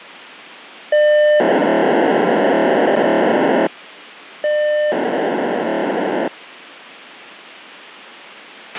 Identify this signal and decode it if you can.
POCSAG pager data (1200 baud), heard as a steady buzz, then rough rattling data, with a squelch burst at the end.